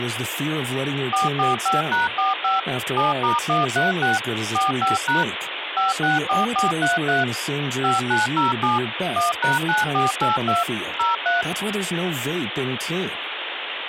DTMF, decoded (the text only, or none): 445#45 7*136 45# 564433 5907 1#9482 03